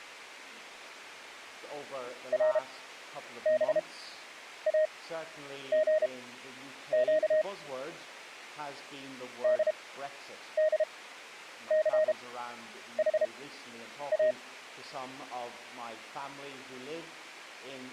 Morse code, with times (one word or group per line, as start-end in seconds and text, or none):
2.3-7.4 RBAGQ
9.4-14.3 DDCHA